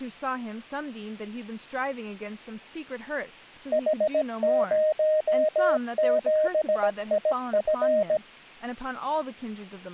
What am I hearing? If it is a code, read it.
Morse code, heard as a keyed tone, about 17 wpm, 620 Hz, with speech in English. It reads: H07IF